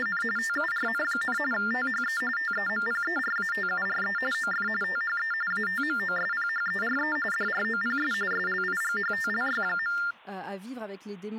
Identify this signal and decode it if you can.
TTY/TDD text telephone tones (45.45 baud Baudot), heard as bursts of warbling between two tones, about 400 Hz shift, 1600 Hz centre, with speech in French. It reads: … TURN, THE TEMPERATURE OF THE ATMOSPHERE DROPS SLIGHTLY.